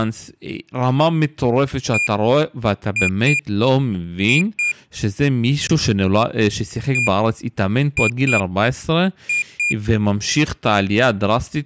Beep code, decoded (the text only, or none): 1-2-2